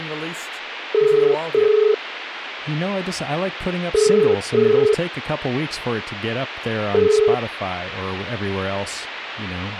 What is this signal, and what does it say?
Telephone call progress tone (as in the UK, Ireland, Australia and similar networks), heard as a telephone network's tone, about 430 Hz, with speech in English. Ringback tone.